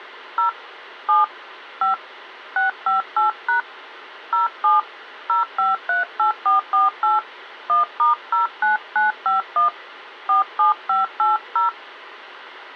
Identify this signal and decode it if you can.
DTMF, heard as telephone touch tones, dialled by hand, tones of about 140 ms. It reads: 0 7 5 658# 07 0538448 1*09951 47580